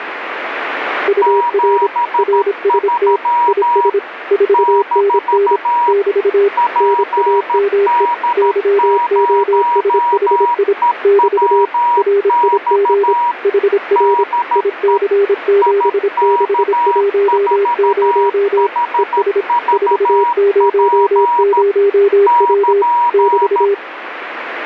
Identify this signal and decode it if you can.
Morse code, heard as two keyed tones, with radio static. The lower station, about 26 wpm, 400 Hz: UR RST IS 4NN <BT> NAME YOSHI <BT> RIG HR IC7610 ES 400W <BT>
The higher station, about 13 wpm, 960 Hz: 73 - PD0EWX DE IK4HVP <KN>